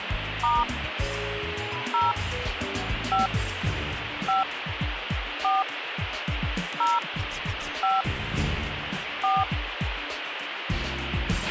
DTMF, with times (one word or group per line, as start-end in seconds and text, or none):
0.4-0.6 *
1.9-2.1 0
3.1-3.3 5
4.3-4.4 5
5.4-5.6 4
6.8-7.0 0
7.8-8.0 5
9.2-9.4 4